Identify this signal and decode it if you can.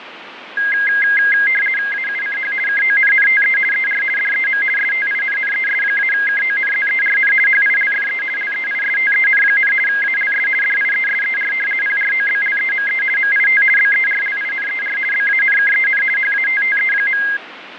RTTY (50 baud, 450 Hz shift), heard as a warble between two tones, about 1850 Hz centre, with radio static and fading. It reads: AUCH KONNTE ER DEM STINNES-KONZERN HILFE LEISTEN, ALS DIESER PROBLEME MIT BERLINER BANKEN HATTE.